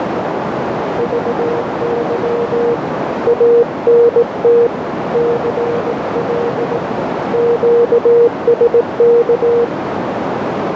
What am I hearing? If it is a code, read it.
Morse code, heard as a keyed tone, hand-sent with a paddle, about 18 wpm, 470 Hz, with heavy radio static and a narrow filter. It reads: VY ANT CL QSK